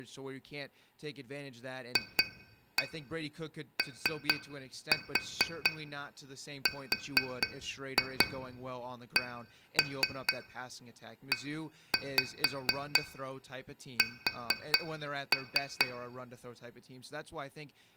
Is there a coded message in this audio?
Yes: tap code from 2.0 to 15.9 s, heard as taps on glass, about 4 knocks a second, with room echo and speech in English. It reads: FORCES